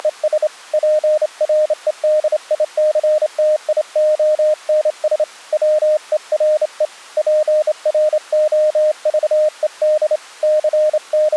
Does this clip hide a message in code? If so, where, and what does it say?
Yes: Morse code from 0.0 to 11.4 s, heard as a keyed tone, hand-sent with a straight key, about 28 wpm, 610 Hz. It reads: … PREDICTIONS WERE PROVED …